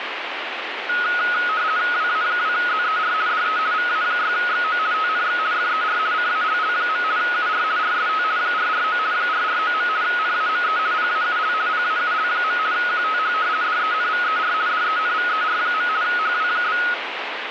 RTTY (50 baud, 170 Hz shift), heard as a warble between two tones, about 1360 Hz centre, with radio static. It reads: WA2ZER DE VA6XO TNX FER CALL. UR RST 449 449. NAME PAUL PAUL. QTH DENVER DENVER. HW?